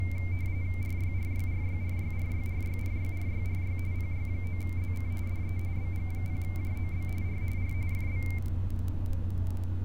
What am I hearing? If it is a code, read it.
RTTY (45.45 baud, 170 Hz shift), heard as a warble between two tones, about 2200 Hz centre, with fading and street noise. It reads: RYRYRYRYRYRYRYRYRY PY9ZC DE BG0JOB R R FB